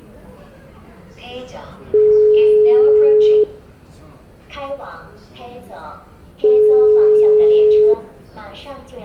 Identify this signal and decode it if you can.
Telephone call progress tone (single-tone plan, as in most of Europe), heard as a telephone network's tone, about 420 Hz, 1.5 s on and 3 s off, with room echo and the noise of a subway station. Ringback tone.